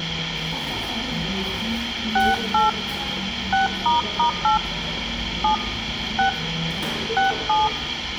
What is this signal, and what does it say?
DTMF, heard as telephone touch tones, dialled by hand, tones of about 140 ms, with radio hiss, room echo and the noise of a cafe. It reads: 68 6**8 7 6 67